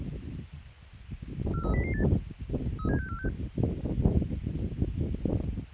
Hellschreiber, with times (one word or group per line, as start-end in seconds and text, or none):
none